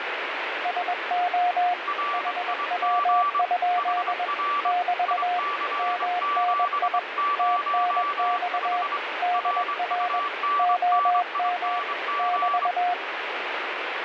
Morse code, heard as two keyed tones, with radio static. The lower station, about 21 wpm, 710 Hz: SO HW? <BT> MNI TNX DR OM <BT>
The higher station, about 24 wpm, 1160 Hz: RIG HR IC705 RUNNING